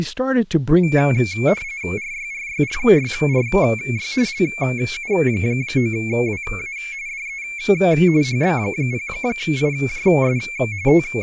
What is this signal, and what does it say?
RTTY (45.45 baud, 170 Hz shift), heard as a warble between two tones, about 2250 Hz centre, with speech in English. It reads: RYRYRYRY LU9WA DE HB0IJS …